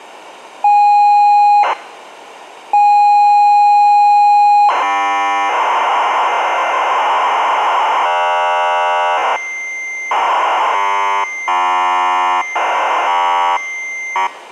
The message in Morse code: none

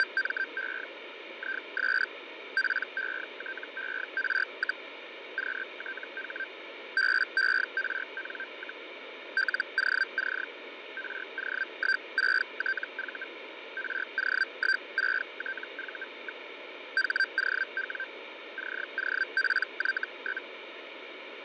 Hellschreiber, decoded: … IS PETER, QTH BERN, LOC RO16TV RO16TV. HOW COPY?

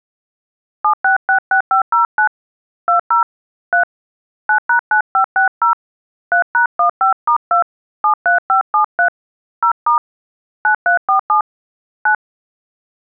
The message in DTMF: 7666509 20 3 9#9560 3#15*2 73573 0* 9347 9

